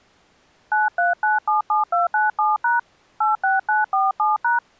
DTMF, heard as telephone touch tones, dialled by hand, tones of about 160 ms. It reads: 93977297# 86947#